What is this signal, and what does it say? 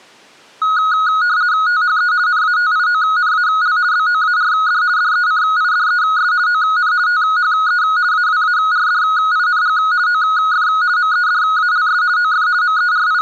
RTTY (50 baud, 170 Hz shift), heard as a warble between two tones, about 1360 Hz centre. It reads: THE NATIONAL BOARD DECIDES ON THE AWARDING OF MEDALS OF …